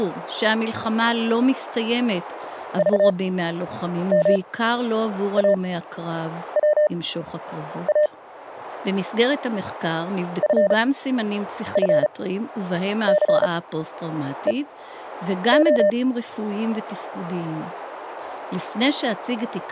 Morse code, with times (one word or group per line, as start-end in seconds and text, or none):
2.8-8.1 VMAWA
10.4-15.9 FFCEO